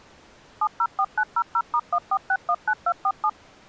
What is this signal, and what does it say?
DTMF, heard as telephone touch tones, dialled by machine, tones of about 60 ms. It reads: 704900*14619247